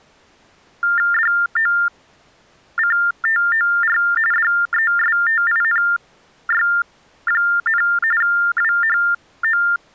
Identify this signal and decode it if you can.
TTY/TDD text telephone tones (45.45 baud Baudot), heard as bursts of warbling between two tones, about 400 Hz shift, 1600 Hz centre. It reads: DOCTOR DESTINY, WHO